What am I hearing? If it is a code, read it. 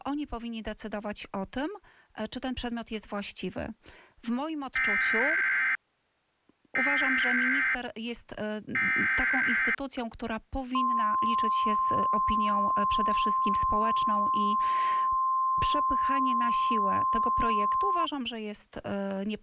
Emergency Alert System (SAME) tones (header bursts, then the 1050 Hz attention tone), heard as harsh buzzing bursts, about 520.83 baud.